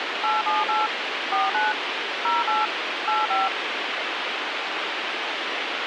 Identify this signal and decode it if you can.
DTMF, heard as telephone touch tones, dialled by machine, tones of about 180 ms, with radio hiss. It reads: 878 49 08 85